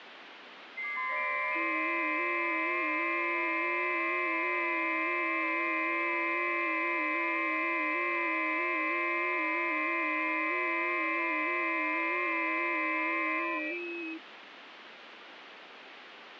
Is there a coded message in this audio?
Yes: FT8 (several signals at once) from 0.8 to 14.2 s, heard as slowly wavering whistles, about 6.25 baud, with radio static.